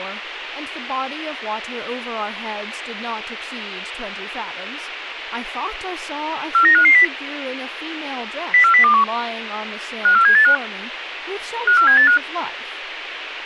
Five-tone selective call (CCIR), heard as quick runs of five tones, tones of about 100 ms, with radio hiss and speech in English. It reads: 49550 04021 54785 54785